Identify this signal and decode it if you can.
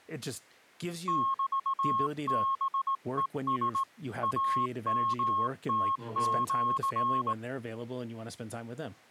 Morse code (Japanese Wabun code), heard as a keyed tone, hand-sent with a straight key, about 18 wpm, 1080 Hz, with speech in English. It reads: メハヘラ イヨムシ